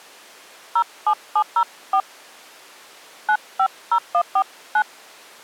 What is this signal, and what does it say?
DTMF, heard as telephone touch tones, dialled by hand, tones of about 70 ms. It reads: 07704 950149